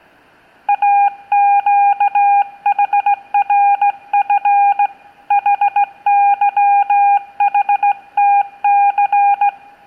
Morse code (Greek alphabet), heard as a keyed tone, hand-sent with a straight key, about 16 wpm, 810 Hz, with room echo. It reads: ΑΨΗΡΦ ΗΥΗΤΘ